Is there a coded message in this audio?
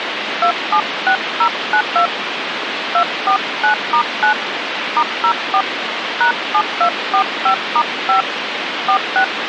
Yes: DTMF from 0.4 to 9.2 s, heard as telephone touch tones, dialled by hand, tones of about 90 ms, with phone line noise. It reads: 276092 249*9 *04 #7245*5 46